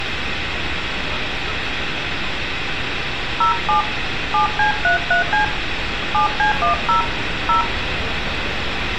DTMF, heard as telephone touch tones, dialled by hand, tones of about 120 ms, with radio hiss, room echo and street noise. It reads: 07 7C33C 7C10 0